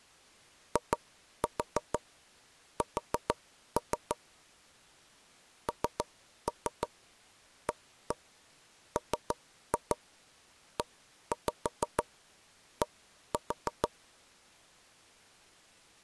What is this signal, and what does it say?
Tap code, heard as knocks on wood, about 6 knocks a second. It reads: IS NAMED